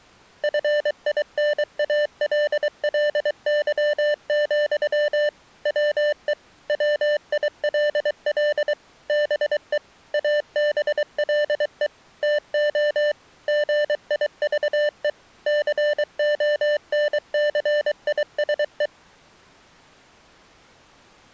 Morse code, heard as electronic beeps, machine-sent, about 23 wpm, 590 Hz. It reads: FINALLY, WE WILL BE ABLE TO GIVE CONCISE